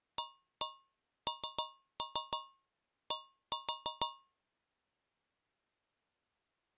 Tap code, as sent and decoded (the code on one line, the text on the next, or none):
1-1 3-3 1-4
AND